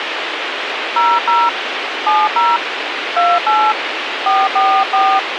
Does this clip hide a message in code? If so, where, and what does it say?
Yes: DTMF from 1.0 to 5.2 s, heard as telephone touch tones, dialled by hand, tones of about 230 ms, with radio hiss. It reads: 00 70 28 444